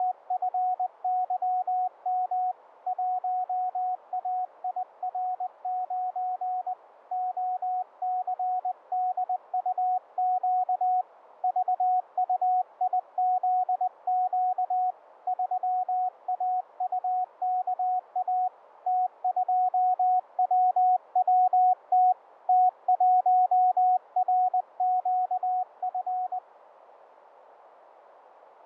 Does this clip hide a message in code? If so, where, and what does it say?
Yes: Morse code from 0.0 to 26.4 s, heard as a keyed tone, hand-sent with a paddle, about 20 wpm, 740 Hz, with radio static and fading. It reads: … 1AIR9 OCDUQ VUIZQ 3AUKA T2WWT T1RQF